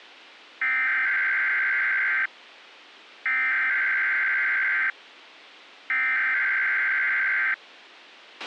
Emergency Alert System (SAME) tones (header bursts), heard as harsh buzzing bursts, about 520.83 baud, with a squelch burst at the end.